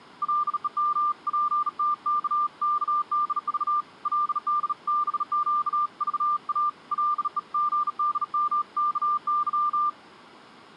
Morse code (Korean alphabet), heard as a keyed tone, hand-sent with a bug key, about 37 wpm, 1190 Hz. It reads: 감정을 그대로 가슴에